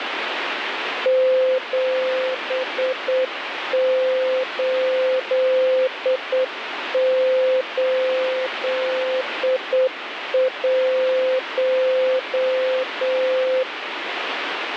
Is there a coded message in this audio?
Yes: Morse code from 1.0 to 13.7 s, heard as a keyed tone, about 8 wpm, 520 Hz, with radio static. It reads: 7881